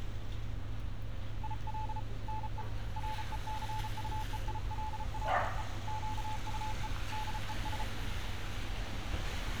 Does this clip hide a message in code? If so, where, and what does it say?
Yes: Morse code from 1.4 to 7.9 s, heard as a keyed tone, hand-sent with a paddle, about 34 wpm, 870 Hz, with street noise. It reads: IL NE RECUEILLE QUE DES